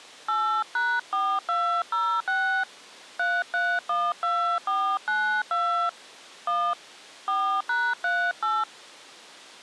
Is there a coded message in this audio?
Yes: DTMF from 0.3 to 8.6 s, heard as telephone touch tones, dialled by hand, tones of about 300 ms. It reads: 8#4206 3312492 1 4#38